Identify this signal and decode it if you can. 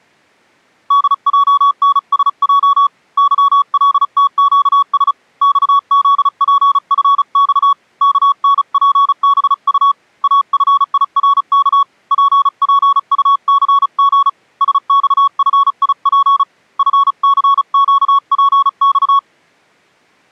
Morse code, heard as a keyed tone, hand-sent with a paddle, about 35 wpm, 1120 Hz. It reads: DJNSJ YLTQS XZPFX KNPBU AFIRK PPUCG SXFIP FCQPX